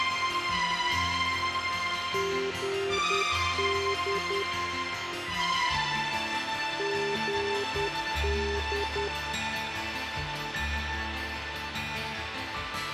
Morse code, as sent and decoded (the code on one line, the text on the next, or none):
--. -.. / --. -..
GD GD